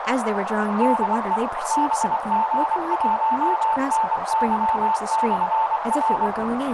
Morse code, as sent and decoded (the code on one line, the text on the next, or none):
-.. . / -... --. .---- -. -.-- -..-. .-.
DE BG1NY/R